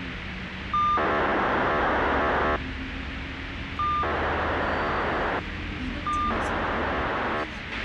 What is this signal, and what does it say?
POCSAG pager data (2400 baud), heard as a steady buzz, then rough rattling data, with radio hiss, a squelch burst at the end and the noise inside a bus.